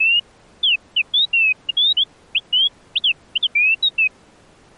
Bird-like chirps. There is no code.